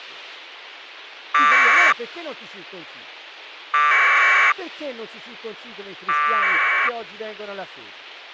Packet radio (AX.25, as in APRS), 1200 baud, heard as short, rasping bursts, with speech in Italian.